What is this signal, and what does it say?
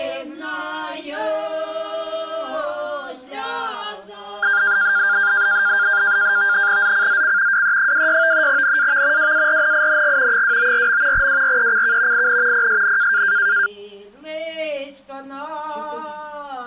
NAVTEX (SITOR-B), 100 baud, 170 Hz shift, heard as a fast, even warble, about 1500 Hz centre. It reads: ZCZC WE26 NAV WARNING 294. WRECK IN PSN